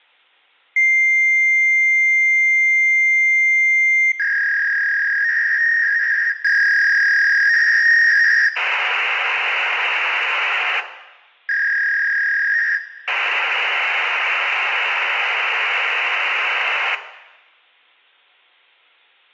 Fax machine handshake, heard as a long tone, a warble and hiss, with room echo.